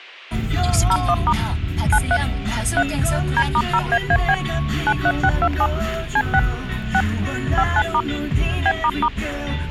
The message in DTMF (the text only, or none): 01* 93 3 D*0AAB 93627 C6 6 59* B**